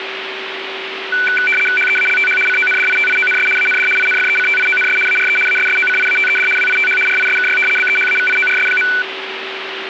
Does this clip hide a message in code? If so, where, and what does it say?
Yes: RTTY (75 baud, 850 Hz shift) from 1.1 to 9.0 s, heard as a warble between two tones, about 1900 Hz centre, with radio static and a steady whistle near 380 Hz. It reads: HEALTH CONDITIONS AND INFECTIONS ARE ASSOCIATED WITH RISKY BEHAVIORS.